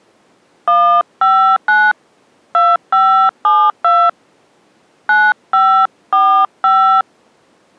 DTMF, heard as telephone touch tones, dialled by hand, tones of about 290 ms. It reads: 159 2572 9545